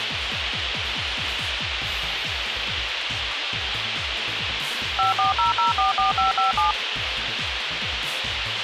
DTMF, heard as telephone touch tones, dialled by machine, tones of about 140 ms, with radio hiss. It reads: 540044557